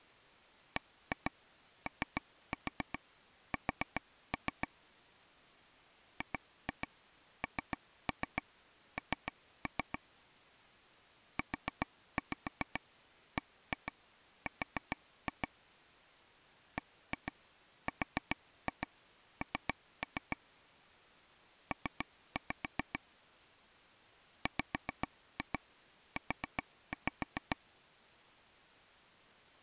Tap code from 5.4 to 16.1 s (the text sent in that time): GNN UBR